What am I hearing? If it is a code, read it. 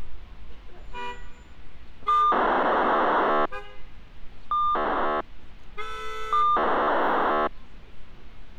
POCSAG pager data (2400 baud), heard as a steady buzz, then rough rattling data, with street noise.